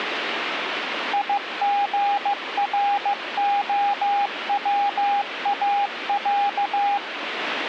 Morse code (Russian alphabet), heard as a keyed tone, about 15 wpm, 810 Hz, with radio static. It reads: ИГРОВАЯ